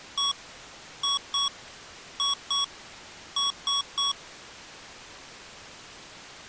Beep code, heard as beeps from a small speaker, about 1120 Hz. 1-2-2-3. In Phoenix BIOS tables: BIOS ROM checksum failure.